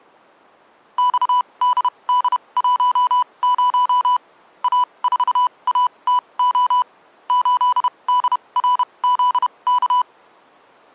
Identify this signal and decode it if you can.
Morse code, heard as electronic beeps, machine-sent, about 31 wpm, spaced as for 24 wpm, 990 Hz. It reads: XDD10 A4ATO 8DRZK